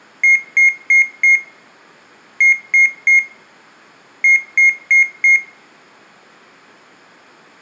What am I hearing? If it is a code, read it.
Beep code, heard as a piezo beeper, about 2150 Hz, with room echo. 4-3-4. In Phoenix BIOS tables: time-of-day clock failure.